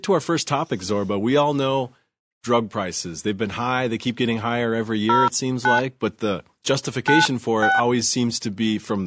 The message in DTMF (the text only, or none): 09 96